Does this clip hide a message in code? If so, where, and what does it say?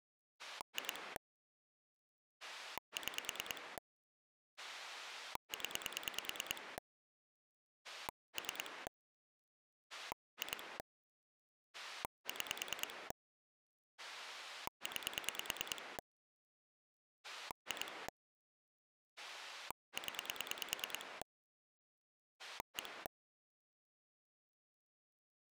Yes: pulse dialling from 0.4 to 23.1 s, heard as a rotary dial, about 9 pulses a second. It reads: 2 6 0 3 2 6 9 2 0 1